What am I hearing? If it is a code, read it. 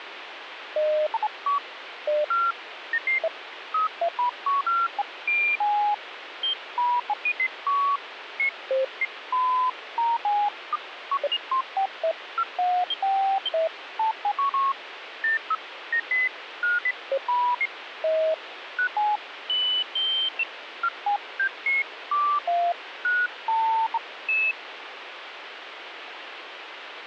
Electronic bleeps of random pitch and length, with radio static. There is no code.